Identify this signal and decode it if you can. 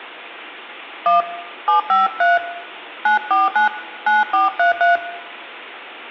DTMF, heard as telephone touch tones, dialled by hand, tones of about 130 ms, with room echo. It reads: 1 753 949 9433